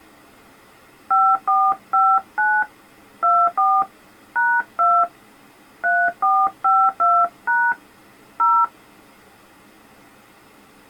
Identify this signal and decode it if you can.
DTMF, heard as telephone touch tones, dialled by hand, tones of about 250 ms. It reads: 5459 24 #2 3452# 0